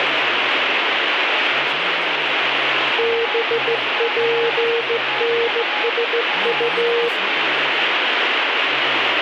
Morse code, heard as a keyed tone, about 15 wpm, 470 Hz, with radio static, a weaker station near 840 Hz and speech in Korean. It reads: BPNSU